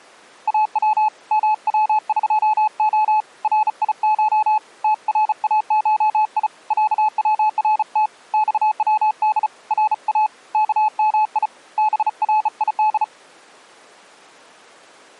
Morse code (Persian alphabet), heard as a keyed tone, hand-sent with a bug key, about 35 wpm, 860 Hz. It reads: او موقع ریش تراشی صورت خود را کمی برید